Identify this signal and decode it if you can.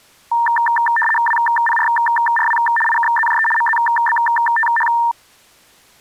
RTTY (75 baud, 850 Hz shift), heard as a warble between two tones, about 1360 Hz centre. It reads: WPRRW IKZJE MZBTH